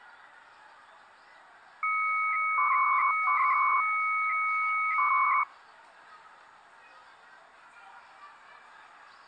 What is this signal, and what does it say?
300-baud modem data (Bell 103 tones), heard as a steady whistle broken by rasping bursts, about 300 baud, 200 Hz shift, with the noise of a residential street.